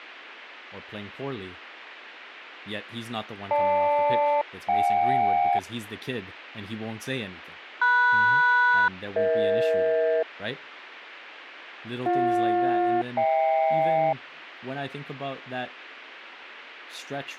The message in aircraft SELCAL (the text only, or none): GL-JK MS-EH BJ-HK